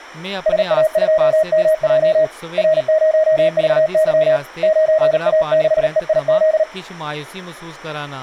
Morse code, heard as a keyed tone, hand-sent with a paddle, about 38 wpm, 630 Hz, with speech in Dogri. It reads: SA2MJ R0VY 9A6EIZ